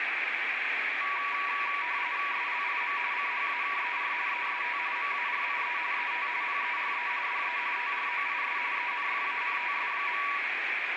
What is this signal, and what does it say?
RTTY (45.45 baud, 170 Hz shift), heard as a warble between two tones, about 1050 Hz centre, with radio static. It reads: SLIM CHAKER EST MARIE ET PERE DE TROIS ENFANTS.